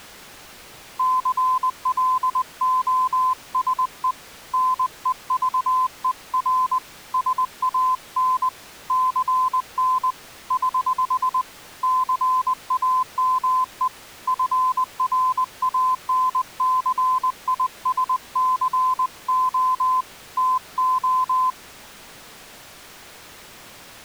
Morse code, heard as a keyed tone, hand-sent with a paddle, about 20 wpm, 1020 Hz. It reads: CLOSE NEVER SAN CN <HH> CAME FRANCISCO TO